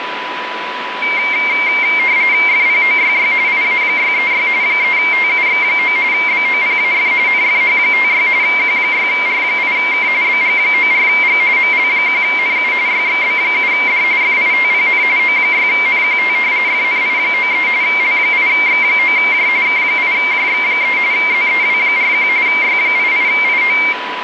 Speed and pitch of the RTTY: 45.45 baud, 170 Hz shift, 2200 Hz centre

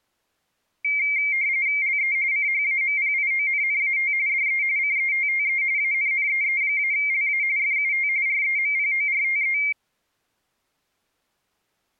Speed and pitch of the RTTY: 45.45 baud, 170 Hz shift, 2200 Hz centre

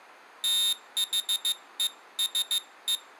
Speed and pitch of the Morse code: 15 wpm, 3700 Hz

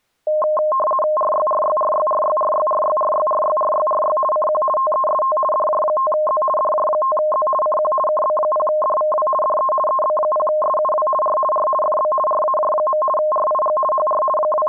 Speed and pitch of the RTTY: 50 baud, 450 Hz shift, 840 Hz centre

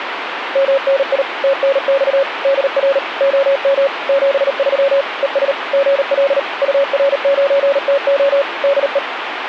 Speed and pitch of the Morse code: 38 wpm, 550 Hz

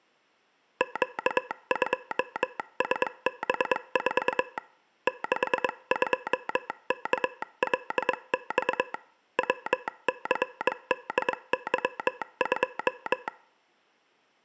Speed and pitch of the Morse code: 22 wpm

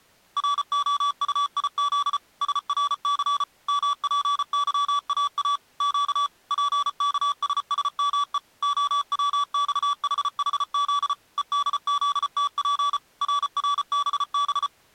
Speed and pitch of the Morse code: 34 wpm, 1150 Hz

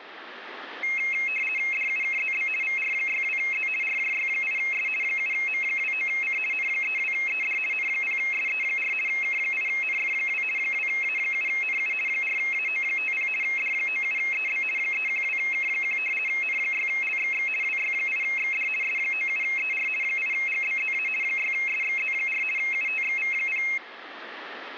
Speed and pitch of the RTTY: 50 baud, 450 Hz shift, 2350 Hz centre

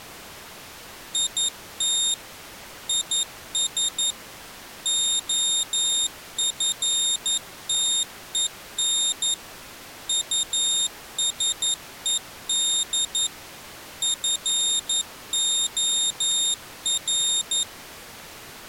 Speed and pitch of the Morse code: 11 wpm, 3700 Hz

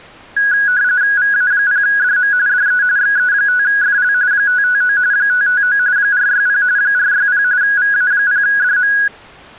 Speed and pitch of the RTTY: 45.45 baud, 170 Hz shift, 1550 Hz centre

